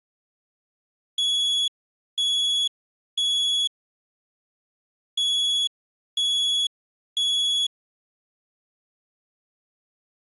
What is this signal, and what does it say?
Alarm pattern, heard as an alarm's beeps, played twice, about 3350 Hz. Temporal three. Smoke or fire, evacuate.